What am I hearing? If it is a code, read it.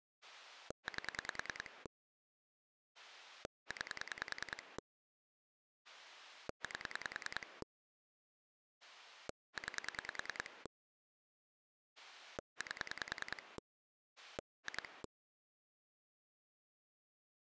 Pulse dialling, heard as a rotary dial, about 10 pulses a second. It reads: 8 9 8 9 8 2